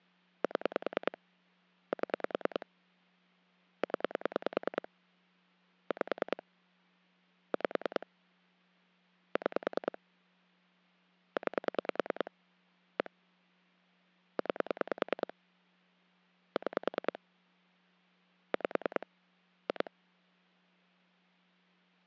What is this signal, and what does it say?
Pulse dialling, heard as clicks on a phone line, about 10 pulses a second. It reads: 7 7 0 5 5 6 9 1 9 6 5 2